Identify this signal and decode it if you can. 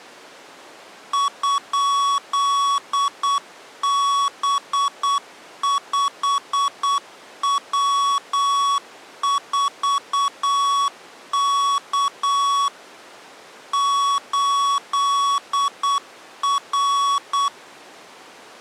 Morse code, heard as electronic beeps, machine-sent, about 8 wpm, 1120 Hz. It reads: ?B5W4K 8R